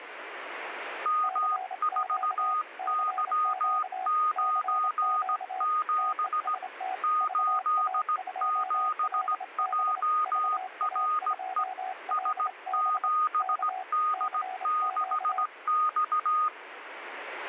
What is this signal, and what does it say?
Morse code, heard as two keyed tones, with radio static. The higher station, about 17 wpm, 1240 Hz: M4Y97 87JRE S7D6X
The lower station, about 27 wpm, 750 Hz: CQ CQ CQ TEST VA2LB VA2LB K CQ